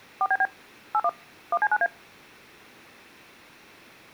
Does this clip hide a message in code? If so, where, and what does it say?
Yes: DTMF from 0.2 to 1.9 s, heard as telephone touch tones, dialled by machine, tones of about 50 ms. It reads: 4BB 81 1C9A